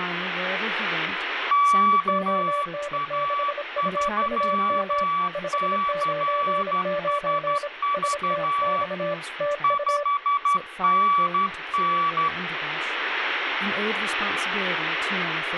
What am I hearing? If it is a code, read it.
Morse code, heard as two keyed tones, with radio static and speech in English. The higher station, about 12 wpm, 1150 Hz: KA3CSV 5NN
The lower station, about 26 wpm, 580 Hz: ON6UUM 599 STX TU